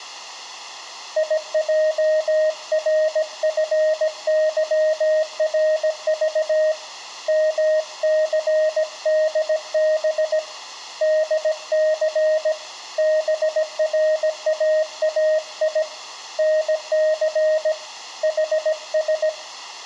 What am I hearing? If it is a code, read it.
Morse code, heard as a keyed tone, hand-sent with a paddle, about 17 wpm, 620 Hz, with room echo. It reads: IJRFYRV MCDB DC BRAAI NC HS